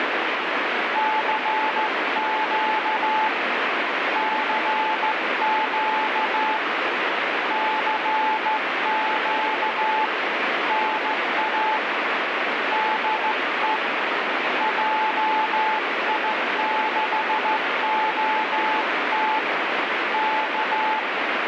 Morse code, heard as a keyed tone, hand-sent with a straight key, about 14 wpm, 870 Hz, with heavy radio static. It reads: CQ CQ CQ NA DE JI6OT K